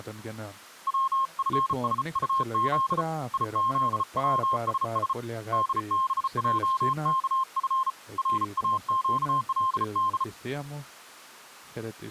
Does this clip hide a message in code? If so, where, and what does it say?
Yes: Morse code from 0.8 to 10.3 s, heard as a keyed tone, hand-sent with a bug key, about 34 wpm, 1060 Hz, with speech in Greek. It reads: WFSUZ IZWSS DBJKF RAQLD